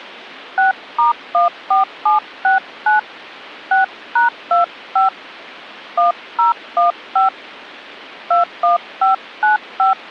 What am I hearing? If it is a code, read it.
DTMF, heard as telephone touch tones, dialled by hand, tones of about 140 ms. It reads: 6*14769 6#25 1015 21595